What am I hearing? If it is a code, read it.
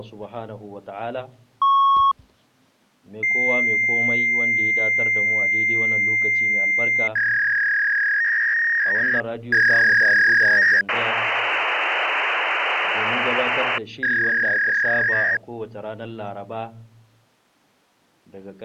Fax machine handshake, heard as a beep, a long tone, a warble and hiss.